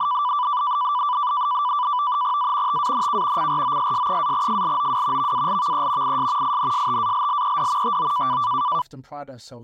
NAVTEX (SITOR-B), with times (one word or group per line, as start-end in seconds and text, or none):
2.4-2.8 A
2.7-3.5 TANK
3.4-5.3 CROSS-FLOW
5.2-6.2 VALVE
6.0-6.6 IS
6.4-8.0 INSTALLED
7.8-8.4 TO